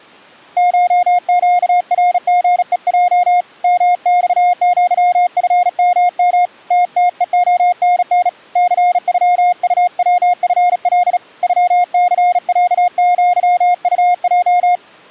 Morse code (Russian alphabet), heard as a keyed tone, hand-sent with a bug key, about 36 wpm, 710 Hz. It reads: ШЩРГЕЙ МЬЪФММ ТТЕОНН ЦЮУВФЛ ЮЦЯЪУЙ